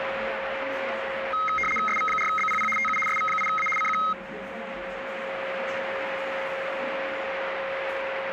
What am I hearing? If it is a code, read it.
RTTY (75 baud, 850 Hz shift), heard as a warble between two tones, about 1700 Hz centre, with radio static, a steady whistle near 540 Hz and the noise of a crowd indoors. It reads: SV4BPP TU SV8A CQ